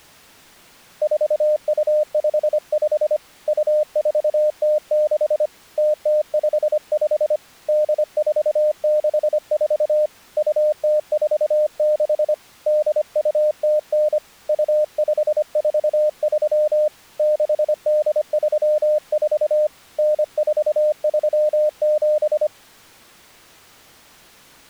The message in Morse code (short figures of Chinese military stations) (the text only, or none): 4255 2406 0055 8464 2046 8209 2543 6834 9437